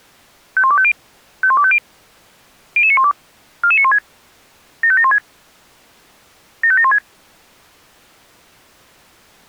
Five-tone selective call (ZVEI), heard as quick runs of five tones, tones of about 70 ms. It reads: 51250 51250 00912 44916 75716 75716